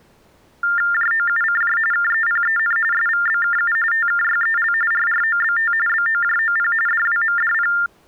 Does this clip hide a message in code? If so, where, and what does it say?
Yes: TTY/TDD text telephone tones (45.45 baud Baudot) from 0.6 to 7.9 s, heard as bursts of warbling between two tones, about 400 Hz shift, 1600 Hz centre. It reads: JOUCJ KEPEN SVBKU TKYEL RROBT BOJOP DWMDP